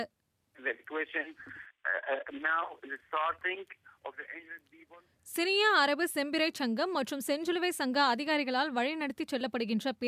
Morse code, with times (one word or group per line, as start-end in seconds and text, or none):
none